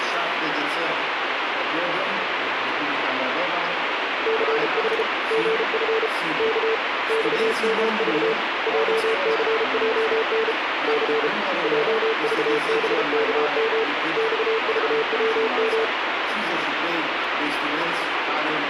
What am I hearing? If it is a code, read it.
Morse code, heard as a keyed tone, hand-sent with a bug key, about 33 wpm, 450 Hz, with radio static. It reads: CH GF K XMV JCJN C JVBKM XVWM